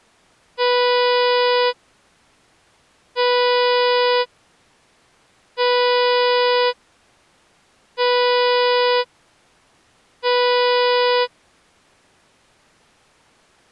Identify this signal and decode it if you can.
Ship horn signal, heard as a ship's horn, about 490 Hz. 5 short. At sea: I doubt that you are doing enough to avoid a collision.